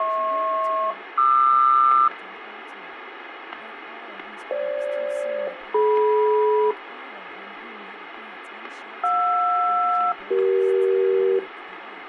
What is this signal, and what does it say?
Aircraft SELCAL, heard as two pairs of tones, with radio static and speech in English. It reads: HP-QR FG-DM JR-CE